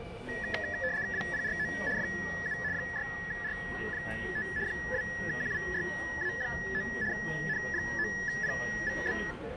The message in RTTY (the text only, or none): WPRO FU 6R5 2QWYA9 N9PVB